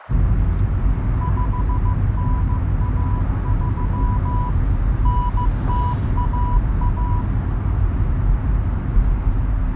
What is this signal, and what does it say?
Morse code (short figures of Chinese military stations), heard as a keyed tone, machine-sent, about 15 wpm, 980 Hz, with heavy radio static, fading, a narrow filter and the noise inside a car. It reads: 5913 9011